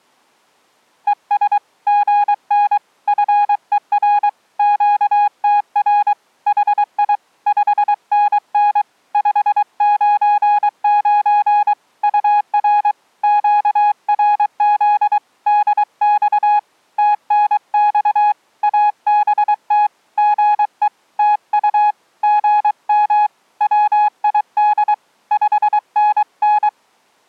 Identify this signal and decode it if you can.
Morse code, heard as a keyed tone, hand-sent with a paddle, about 23 wpm, 830 Hz. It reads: ES GN FER QTR HI 5NN 599 UR QRZ DX TNX ABT GE TU GM WID 5NN